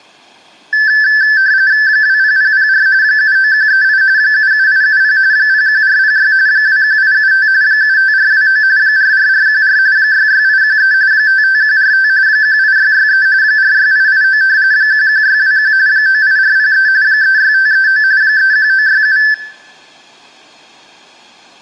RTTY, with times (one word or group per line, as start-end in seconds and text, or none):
1.9-2.9 20004
3.0-4.0 79138
4.2-5.2 77870
5.3-6.3 01406
6.5-7.5 21875
7.6-8.6 75429
8.8-9.8 44414
10.0-10.9 66813
11.1-12.1 55145
12.3-13.3 18663
13.4-14.4 46889
14.7-15.7 11621
15.9-16.9 98403
17.0-18.0 36539
18.2-19.2 31967